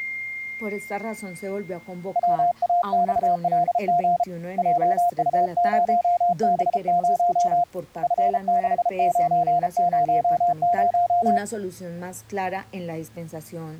Morse code, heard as a keyed tone, hand-sent with a paddle, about 33 wpm, 700 Hz. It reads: WAXLG JU0B0 F6900